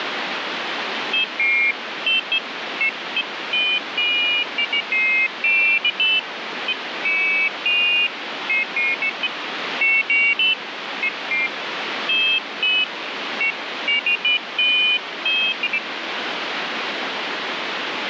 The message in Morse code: none

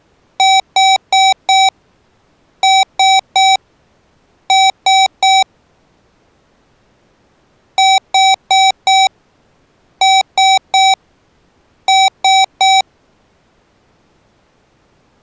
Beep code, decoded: 4-3-3

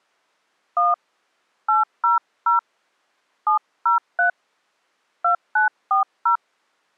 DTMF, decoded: 1 800 703 2940

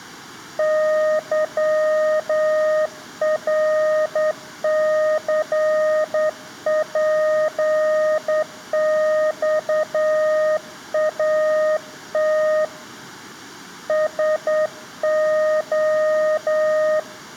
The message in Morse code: YRCPXAT SO

